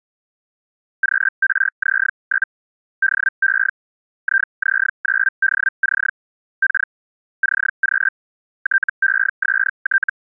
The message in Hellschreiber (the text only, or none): QRZ? DE IZ9DC K CQ TEST